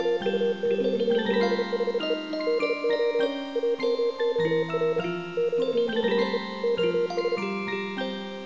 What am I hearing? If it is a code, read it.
Morse code, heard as a keyed tone, hand-sent with a paddle, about 33 wpm, 470 Hz. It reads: … DO AMOR QUE OS